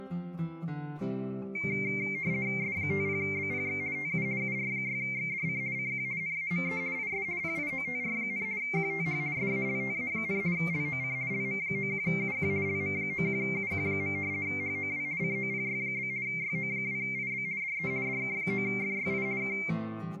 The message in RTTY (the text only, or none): S50BPX TU UR6XDC CQ NAME IS PIOTR, QTH SALTA, LOC LM91UQ LM91UQ. HOW COPY? YO2IB DE DK9FYI K